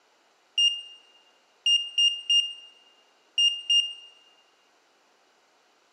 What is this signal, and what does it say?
Beep code, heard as a piezo beeper, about 2800 Hz, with room echo. 1-3-2.